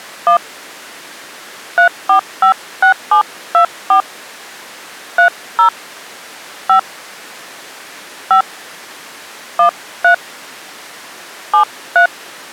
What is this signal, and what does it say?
DTMF, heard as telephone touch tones, dialled by hand, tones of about 100 ms. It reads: 1 3456724 30 5 5 13 73